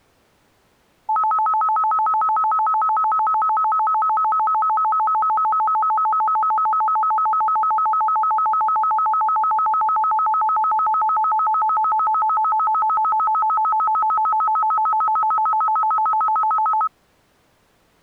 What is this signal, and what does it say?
A tone that alternates evenly between two pitches. There is no code.